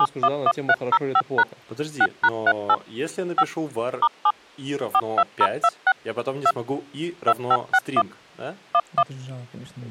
DTMF, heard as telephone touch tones, dialled by machine, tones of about 60 ms, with speech in Russian. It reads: 711305# 6#38 5 *7 42026 2 2561 11